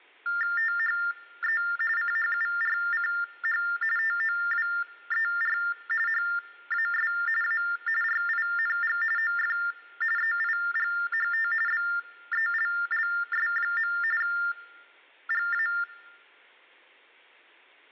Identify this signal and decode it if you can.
TTY/TDD text telephone tones (45.45 baud Baudot), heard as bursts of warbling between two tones, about 400 Hz shift, 1600 Hz centre. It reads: THE CHURCH TOWER HAS A RING OF EIGHT BELLS. GA